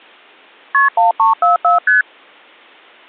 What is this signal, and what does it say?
Multi-frequency trunk signalling (R1, as on North American trunks), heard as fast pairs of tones, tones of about 140 ms. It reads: KP 1344 ST